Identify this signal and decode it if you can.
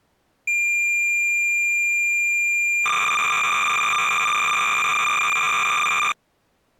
Cassette data (Kansas City type), 300 baud, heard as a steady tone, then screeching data.